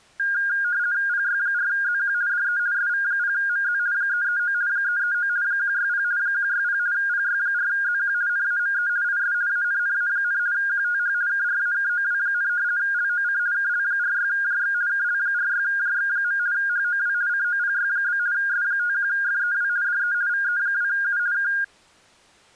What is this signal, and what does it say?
RTTY (50 baud, 170 Hz shift), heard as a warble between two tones, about 1500 Hz centre. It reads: PY4ZQ DE SV0MZ 339 339 160 160 PY4ZQ NAME IS ANNA, QTH KRAKOW, LOC KL46JX KL46JX. HOW COPY? S51FEW DE VE2U K